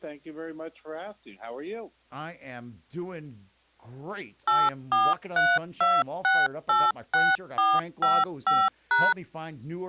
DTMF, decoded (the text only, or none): 8432686455#